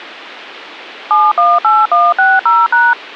DTMF, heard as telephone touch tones, dialled by machine, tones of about 210 ms. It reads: 718160#